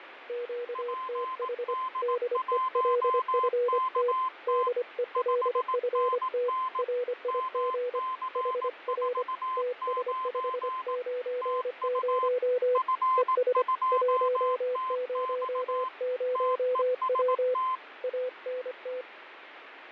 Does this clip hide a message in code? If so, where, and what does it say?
Yes: Morse code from 0.2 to 19.1 s, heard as two keyed tones, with radio static and fading. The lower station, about 25 wpm, 490 Hz: QTH DELFT DELFT RIG HR TS590 ES 100W ANT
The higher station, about 18 wpm, 1040 Hz: PD1KT 5NN MC49 TU F2TX TEST